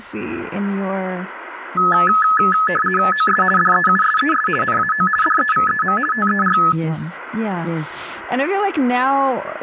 RTTY (50 baud, 450 Hz shift), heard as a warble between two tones, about 1500 Hz centre, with speech in English. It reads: OS DEUSES NAO DEVEM TER